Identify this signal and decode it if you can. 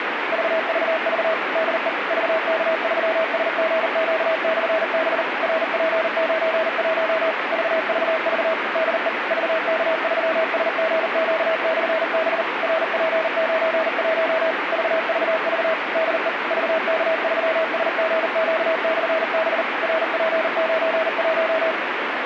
Morse code, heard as a keyed tone, machine-sent, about 39 wpm, 640 Hz, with radio static. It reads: VVV DE VK3SGQ/B RP91 VVV DE VK3SGQ/B RP91 VVV DE VK3SGQ/B RP91